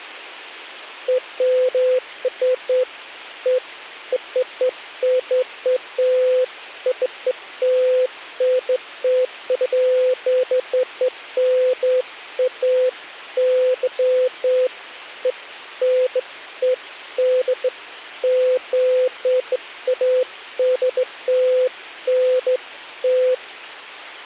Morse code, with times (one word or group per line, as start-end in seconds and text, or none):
none